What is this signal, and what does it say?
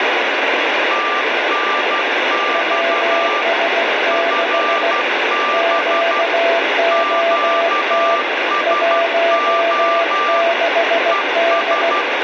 Morse code, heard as two keyed tones, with heavy radio static. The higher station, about 12 wpm, 1180 Hz: TNX FB QSO ES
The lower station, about 16 wpm, 670 Hz: WS6 QOT 16D